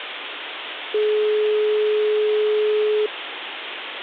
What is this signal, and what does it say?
Telephone call progress tone (425 Hz plan, as in most of Europe), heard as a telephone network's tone, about 420 Hz, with phone line noise. Dial tone.